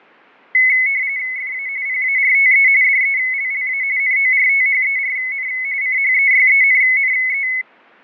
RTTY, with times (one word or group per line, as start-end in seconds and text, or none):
1.4-1.7 FA
1.9-2.7 PARTE
2.8-3.8 DELLA
4.0-5.5 NORTHERN
5.8-7.5 CHEYENNE